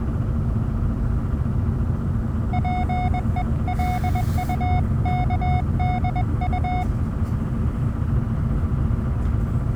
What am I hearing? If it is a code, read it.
Morse code (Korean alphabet), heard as a keyed tone, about 21 wpm, 730 Hz, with the noise inside a bus. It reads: 자기의